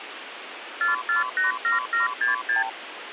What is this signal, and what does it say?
Multi-frequency trunk signalling (R2, with the far end's replies), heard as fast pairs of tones, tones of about 140 ms, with phone line noise. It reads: 4487766